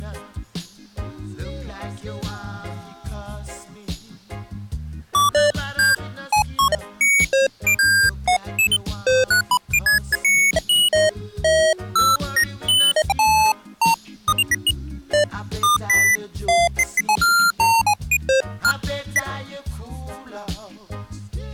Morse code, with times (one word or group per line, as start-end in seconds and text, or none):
none